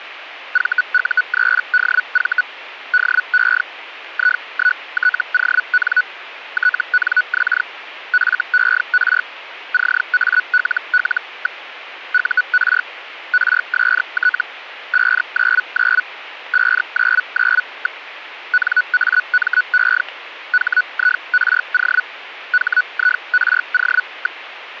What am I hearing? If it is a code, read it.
Hellschreiber (Feld-Hell, 122.5 baud), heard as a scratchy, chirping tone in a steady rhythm, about 1480 Hz. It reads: VU3DV DE I1TON TNX FER CALL. UR RST 599 599. NAME HIRO HIRO.